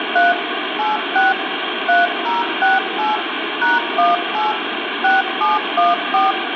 DTMF, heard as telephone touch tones, dialled by machine, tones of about 170 ms, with phone line noise and room echo. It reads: 3 86 3068 #18 6714